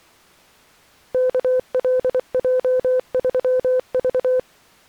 Morse code, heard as a keyed tone, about 24 wpm, 510 Hz. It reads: KLJ3V